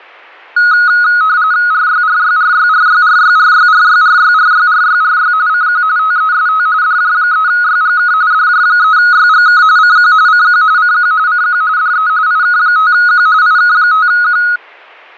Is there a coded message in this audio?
Yes: RTTY (45.45 baud, 170 Hz shift) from 0.6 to 14.6 s, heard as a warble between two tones, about 1360 Hz centre. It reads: RYRYRYRYRYRYRYRYRYRYRY CQ TEST DJ3YGK DJ3YGK CQ CQ CQ CQ DE IK5Q IK5Q